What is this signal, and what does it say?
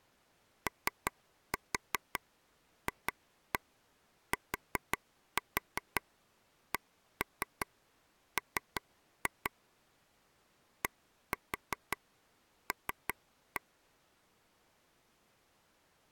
Tap code, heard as taps on a table, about 5 knocks a second. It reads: OFTCM DL